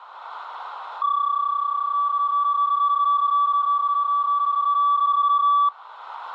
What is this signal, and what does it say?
PSK31 (31.25 baud), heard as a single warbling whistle, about 1150 Hz, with radio static.